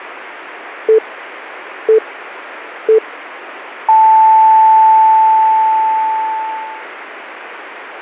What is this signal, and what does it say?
Radio time signal (three low pips and a long one an octave up, as on NHK), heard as pips.